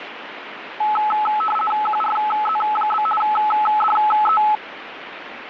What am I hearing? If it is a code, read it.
RTTY (50 baud, 450 Hz shift), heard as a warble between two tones, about 1080 Hz centre, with radio static. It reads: QRZ? DE